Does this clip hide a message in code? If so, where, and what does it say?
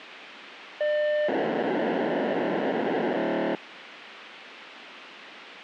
Yes: POCSAG pager data (1200 baud) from 0.8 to 3.6 s, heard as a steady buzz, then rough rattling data, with radio hiss.